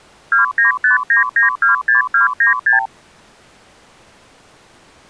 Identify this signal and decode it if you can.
Multi-frequency trunk signalling (R2, with the far end's replies), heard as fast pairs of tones, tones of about 130 ms. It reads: 2959926296